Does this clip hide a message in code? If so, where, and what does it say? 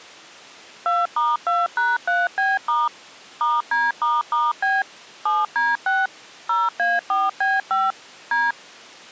Yes: DTMF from 0.9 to 8.5 s, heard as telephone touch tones, dialled by machine, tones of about 200 ms. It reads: 2*2#3B* *D**B 7D6 0A4B5 D